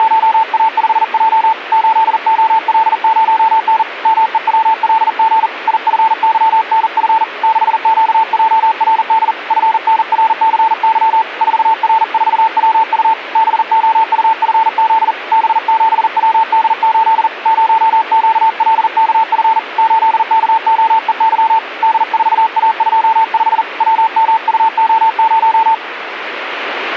Morse code, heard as a keyed tone, hand-sent with a paddle, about 40 wpm, 890 Hz, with radio static. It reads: … 8OL0N MEWLG IFYNF 6QJRD FNRCY 4R4WU BOUFZ B7WD8 0QLKF 8KOEY D4A25 WMUO0